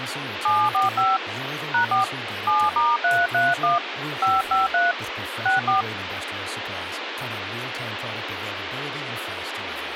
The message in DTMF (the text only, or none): 745 #4 7*331 553 64